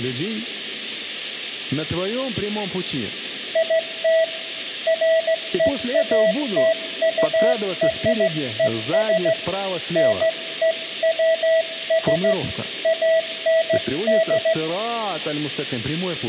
Morse code (American railroad code), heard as a keyed tone, hand-sent with a straight key, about 650 Hz, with room echo. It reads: IT FEATURES NEWS AND